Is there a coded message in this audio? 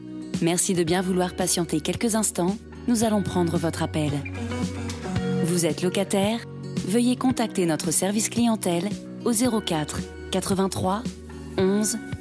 No.